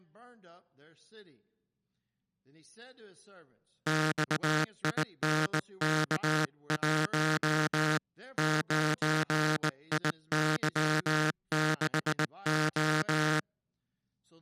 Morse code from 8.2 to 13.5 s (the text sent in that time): 9IY6O